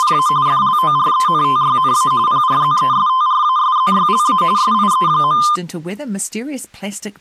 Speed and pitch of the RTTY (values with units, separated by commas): 45.45 baud, 170 Hz shift, 1120 Hz centre